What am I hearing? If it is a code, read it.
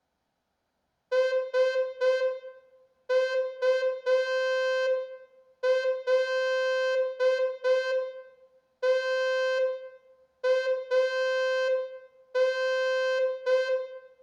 Morse code, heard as a horn, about 5 wpm, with room echo. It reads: SULTAN